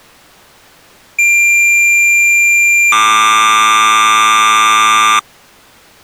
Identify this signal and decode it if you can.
Cassette data (Kansas City type), 1200 baud, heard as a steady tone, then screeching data.